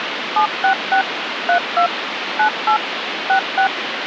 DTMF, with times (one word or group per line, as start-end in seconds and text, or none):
0.4-1.0 766
1.5-1.9 32
2.4-2.8 98
3.3-3.7 66